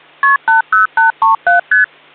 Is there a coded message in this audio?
Yes: multi-frequency trunk signalling (R1, as on North American trunks) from 0.2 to 1.8 s, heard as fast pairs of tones, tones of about 130 ms. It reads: KP 80837 ST